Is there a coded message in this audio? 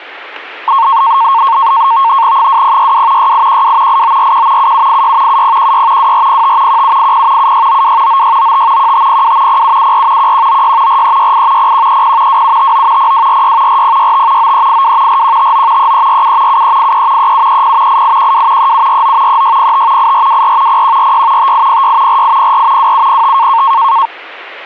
Yes: NAVTEX (SITOR-B), 100 baud, 170 Hz shift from 0.7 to 24.1 s, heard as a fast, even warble, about 1000 Hz centre, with static crashes. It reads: 2062 6812 8941 7786 7016 2405 1780 7692 9695 1502 0774 1196 4368 0130 2759 0246 4065 9382 4159 3347 7383 3730 8812 3749 3605 8424 0146 5806 4804 2705